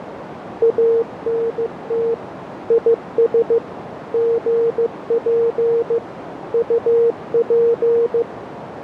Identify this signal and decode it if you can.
Morse code, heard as a keyed tone, machine-sent, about 15 wpm, 460 Hz, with radio static and a narrow filter. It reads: ANT IS GP UP